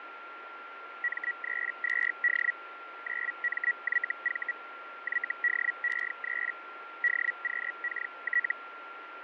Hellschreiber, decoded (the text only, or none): M32D 9MYV YDE3 DQKT